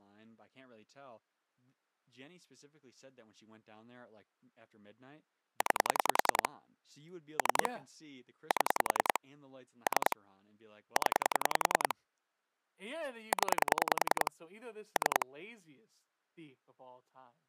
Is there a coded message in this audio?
Yes: pulse dialling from 5.6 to 15.2 s, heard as clicks on a phone line, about 10 pulses a second, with speech in English. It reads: 9 3 7 3 0 0 3